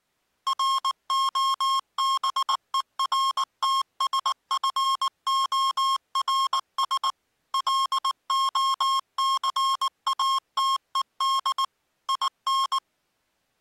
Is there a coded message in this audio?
Yes: Morse code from 0.4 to 12.8 s, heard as electronic beeps, machine-sent, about 19 wpm, 1080 Hz. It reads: ROBERTSFORS LOCATED IN